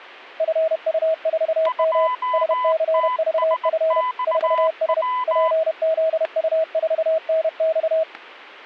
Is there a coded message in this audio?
Yes: Morse code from 0.3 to 8.1 s, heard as two keyed tones, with static crashes. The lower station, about 31 wpm, 640 Hz: FU4M SCVF 4S PZU4NX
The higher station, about 19 wpm, 1000 Hz: 2TSXW